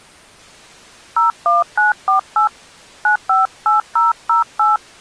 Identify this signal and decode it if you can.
DTMF, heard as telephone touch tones, dialled by hand, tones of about 140 ms. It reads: 01948 958008